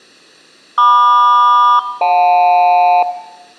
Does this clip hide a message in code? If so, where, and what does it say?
Yes: aircraft SELCAL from 0.8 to 3.0 s, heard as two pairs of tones. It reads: MQ-JL